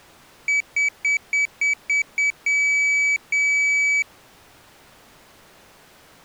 Beep code, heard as a piezo beeper, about 2300 Hz. 7 short, 2 long.